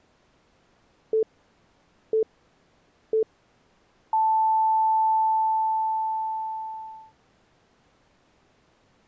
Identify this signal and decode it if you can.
Radio time signal (three low pips and a long one an octave up, as on NHK), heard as pips.